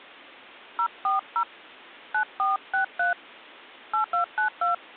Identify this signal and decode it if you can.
DTMF, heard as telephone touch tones, dialled by hand, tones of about 120 ms. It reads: 040 9463 8292